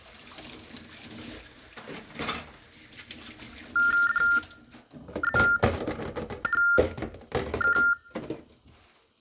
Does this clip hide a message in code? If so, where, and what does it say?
Yes: TTY/TDD text telephone tones (45.45 baud Baudot) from 3.8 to 7.9 s, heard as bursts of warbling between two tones, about 400 Hz shift, 1600 Hz centre, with kitchen noise. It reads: DZHK